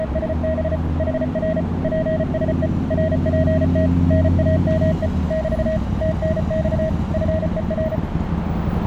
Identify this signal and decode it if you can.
Morse code, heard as a keyed tone, machine-sent, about 34 wpm, 640 Hz, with radio static, a narrow filter and street noise. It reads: … HR PSE RPT NAME <BT> TNX FER